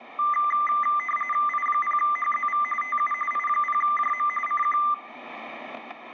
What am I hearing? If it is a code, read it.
RTTY (45.45 baud, 850 Hz shift), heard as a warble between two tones, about 1600 Hz centre, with static crashes. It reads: I0HZV TU I0JM CQ